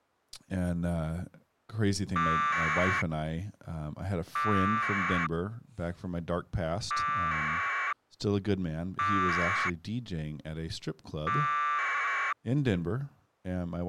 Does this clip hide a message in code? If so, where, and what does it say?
Yes: packet radio (AX.25, as in APRS), 1200 baud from 2.2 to 12.3 s, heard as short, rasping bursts, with speech in English.